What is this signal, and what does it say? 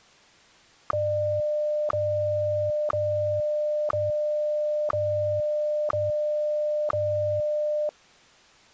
Radio time signal (WWVH, Hawaii), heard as ticks, one a second.